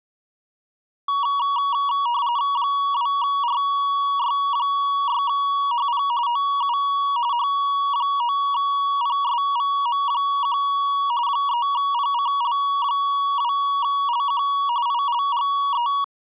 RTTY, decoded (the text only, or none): 2RY6HP OU H9PSVM1 3PCL2LQ ILGE